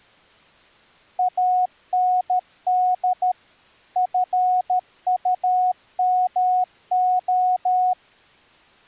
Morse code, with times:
1.2-3.3 AND
4.0-7.9 FUMO

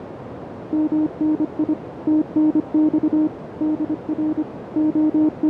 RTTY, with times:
none

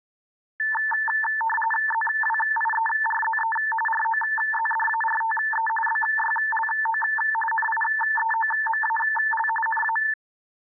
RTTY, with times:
1.9-3.6 ZWIERZE
3.9-5.7 ROZDARTE
5.9-7.0 BYLO
7.5-9.5 NIEOMAL
9.7-10.0 NA

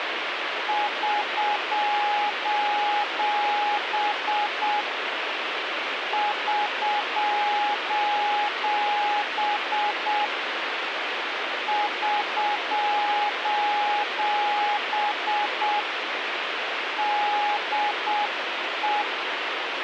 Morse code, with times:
0.7-4.8 <SOS>
6.1-10.2 <SOS>
11.7-15.8 <SOS>
17.0-19.0 DE

